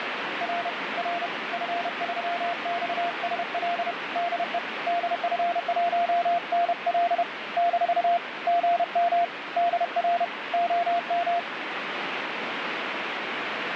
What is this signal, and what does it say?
Morse code, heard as a keyed tone, hand-sent with a paddle, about 31 wpm, 690 Hz, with heavy radio static. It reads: R R F3XSL DE DF1NL - GM DR OM